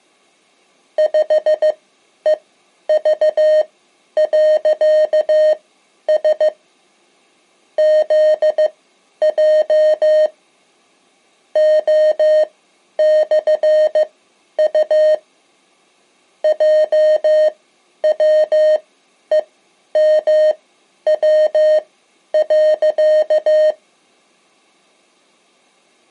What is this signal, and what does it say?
Morse code, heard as electronic beeps, machine-sent, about 15 wpm, spaced as for 10 wpm, 620 Hz. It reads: 5EV.S ZJ O/U JWEMW.